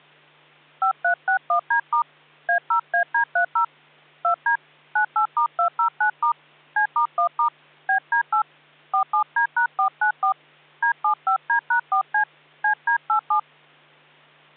DTMF, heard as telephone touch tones, dialled by hand, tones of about 100 ms, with hum. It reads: 5361D* A0AD30 2D 98*209* C*1* BD8 47D#494 D75D#4C CD87